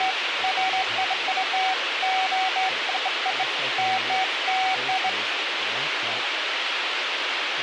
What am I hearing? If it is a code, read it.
Beeps of irregular length, with radio hiss and speech in English. There is no code.